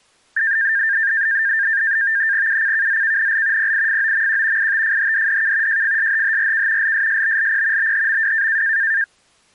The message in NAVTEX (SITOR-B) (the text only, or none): UCKZKNL PIFOMQ ITFHDDK JFSHHRK LSSBLP BHMW